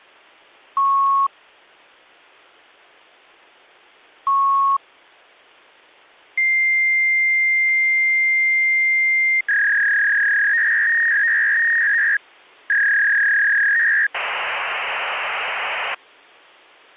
Fax machine handshake, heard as beeps, a long tone, a warble and hiss.